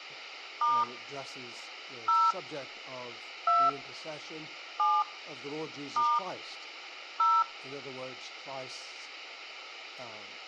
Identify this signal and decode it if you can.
DTMF, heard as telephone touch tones, dialled by hand, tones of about 220 ms. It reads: * 0 2 7 * 0